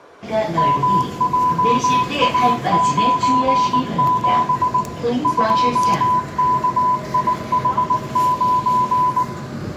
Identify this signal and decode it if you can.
Morse code, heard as a keyed tone, machine-sent, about 19 wpm, 1000 Hz, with room echo and the noise inside a subway train. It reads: MJA97 2KIH9